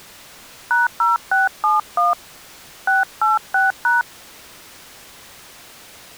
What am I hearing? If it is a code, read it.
DTMF, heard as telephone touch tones, dialled by hand, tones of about 160 ms. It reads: #0671 686#